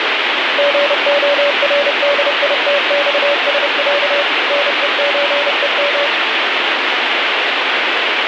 Morse code (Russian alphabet), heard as a keyed tone, machine-sent, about 30 wpm, 570 Hz, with heavy radio static. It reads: ГОРДИТЬСЯ НЕЧЕМ